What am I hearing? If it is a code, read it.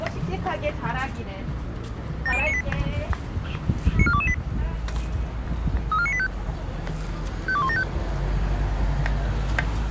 Five-tone selective call (ZVEI), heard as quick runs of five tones, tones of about 70 ms, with the noise of a residential street. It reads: 70098 94228 34985 52175